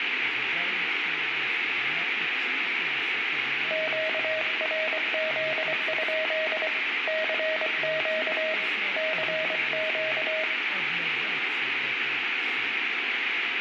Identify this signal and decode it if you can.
Morse code, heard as a keyed tone, hand-sent with a paddle, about 24 wpm, 630 Hz, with radio static, room echo and speech in Russian. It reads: QRZ? CQ CQ